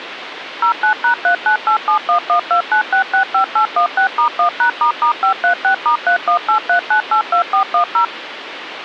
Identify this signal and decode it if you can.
DTMF, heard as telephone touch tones, dialled by machine, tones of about 100 ms, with phone line noise. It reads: 09#39871129665816*1#**536*3183982410